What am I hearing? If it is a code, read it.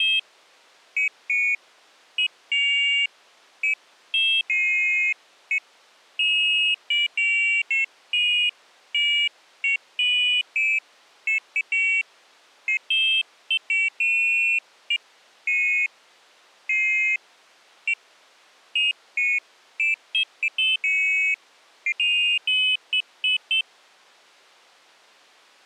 Pairs of high tones at irregular times. There is no code.